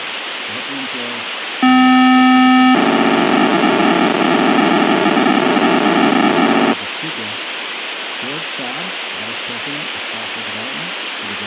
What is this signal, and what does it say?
POCSAG pager data (512 baud), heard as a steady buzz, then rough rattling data, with radio hiss and speech in English.